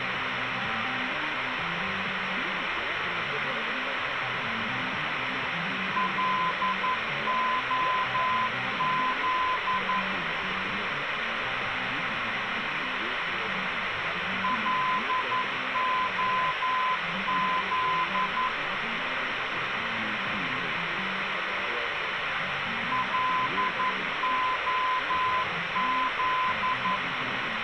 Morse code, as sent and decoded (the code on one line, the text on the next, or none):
.-.. --- --.. / .-.. --- --.. / .-.. --- --..
LOZ LOZ LOZ